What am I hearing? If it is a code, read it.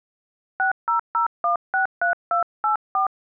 DTMF, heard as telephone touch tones, dialled by hand, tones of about 120 ms. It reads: 600163284